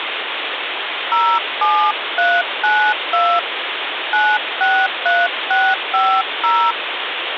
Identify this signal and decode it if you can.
DTMF, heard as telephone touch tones, dialled by hand, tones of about 260 ms, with phone line noise. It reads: 07392 963650